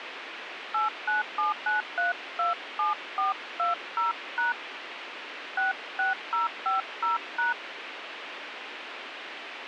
DTMF, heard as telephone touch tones, dialled by hand, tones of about 140 ms, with radio hiss. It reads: 8979327420# 66050#